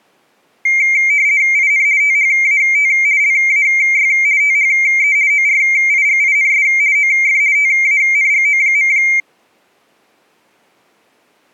RTTY (50 baud, 170 Hz shift), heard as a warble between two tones, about 2200 Hz centre. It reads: IN THAT LAY THE ORIGINS OF TANGO.